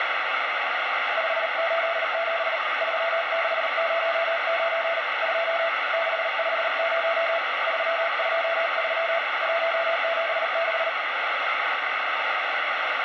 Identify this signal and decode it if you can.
Morse code, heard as a keyed tone, hand-sent with a paddle, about 38 wpm, 670 Hz, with heavy radio static. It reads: 587 3609 2 650 323 176